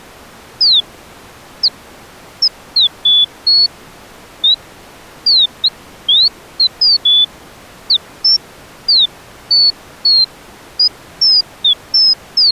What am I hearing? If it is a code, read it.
Bird-like chirps. There is no code.